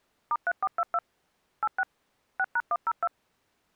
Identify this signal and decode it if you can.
DTMF, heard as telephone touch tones, dialled by machine, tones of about 50 ms. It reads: *3422 86 6#102